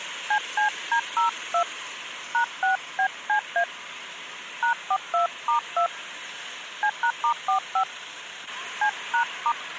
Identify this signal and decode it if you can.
DTMF, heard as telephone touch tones, dialled by hand, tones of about 90 ms, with street noise. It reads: CCD02 #6BCA #42*2 C#*45 C#*